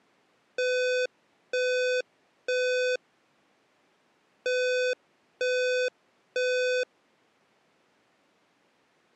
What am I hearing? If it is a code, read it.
Alarm pattern, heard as an alarm's beeps, played twice, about 500 Hz. Temporal three. Smoke or fire, evacuate.